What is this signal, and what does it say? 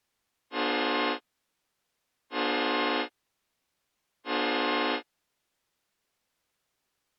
Train horn signal, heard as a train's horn. 3 short. On North American railways: when stopped, the train will back up.